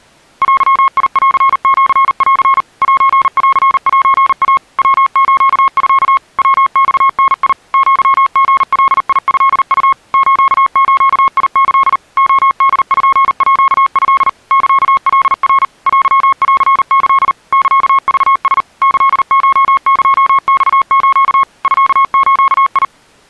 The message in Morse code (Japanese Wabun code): デンシン センセイ ヤスミ ヤマダ アリガトウ スズキ レポート サカナ テンキ サクラ キコエマス ミズ

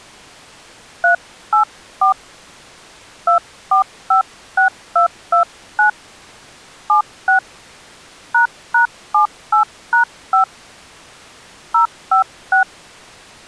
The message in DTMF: 384 2456229 76 ##78#5 056

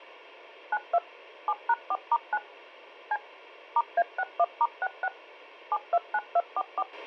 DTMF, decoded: 92 7#4*9 C *A61*66 729244

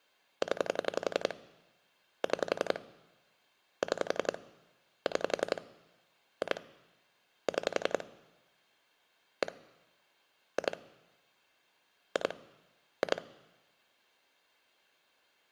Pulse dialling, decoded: 0 6 6 6 2 6 1 2 2 2

